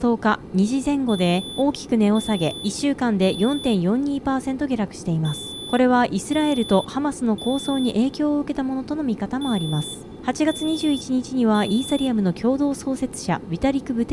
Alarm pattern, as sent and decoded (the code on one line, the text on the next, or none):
3 beeps and a pause
temporal three